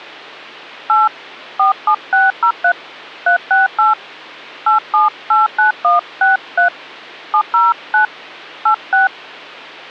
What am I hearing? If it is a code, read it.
DTMF, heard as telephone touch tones, dialled by hand, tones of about 130 ms, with hum. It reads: 8 47603 368 8789163 709 86